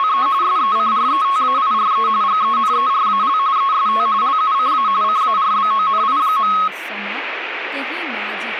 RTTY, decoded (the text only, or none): … SECRETAIRE GENERAL EST LUCA CARBONI.